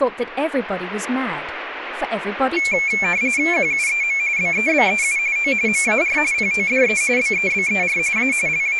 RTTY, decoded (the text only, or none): QUEM BEBEU O MAR PODE BEBER A …